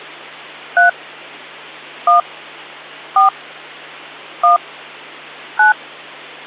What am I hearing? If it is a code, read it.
DTMF, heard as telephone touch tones, dialled by hand, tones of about 130 ms, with hum. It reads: 3 1 4 1 9